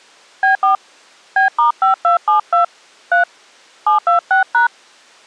DTMF, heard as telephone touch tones, dialled by hand, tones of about 120 ms. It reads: B4 B*5272 3 726#